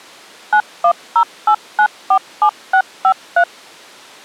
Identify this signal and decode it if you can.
DTMF, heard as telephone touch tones, dialled by machine, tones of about 80 ms. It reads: 9108947653